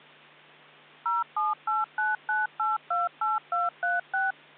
DTMF, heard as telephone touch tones, dialled by machine, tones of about 170 ms, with hum. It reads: 07899828236